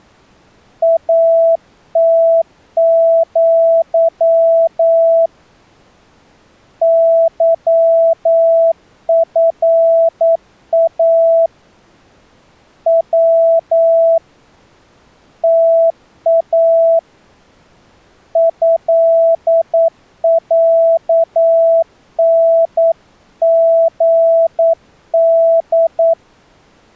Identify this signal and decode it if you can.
Morse code (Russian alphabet), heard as a keyed tone, hand-sent with a paddle, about 9 wpm, 660 Hz. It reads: АТЪ ЫФА В ТА ЭЯНГД